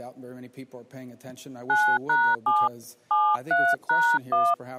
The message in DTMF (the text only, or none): 9#7 73#1